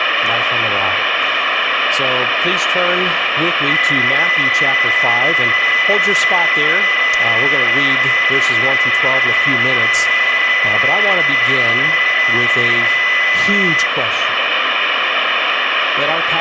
PSK31 (31.25 baud), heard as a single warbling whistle, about 2000 Hz, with radio static and room echo.